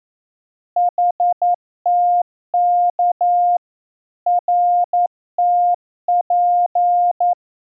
Morse code, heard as a keyed tone, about 11 wpm, 710 Hz. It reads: HTK RTP